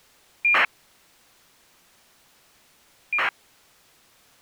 ACARS aircraft data, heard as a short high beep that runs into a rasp, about 2400 baud.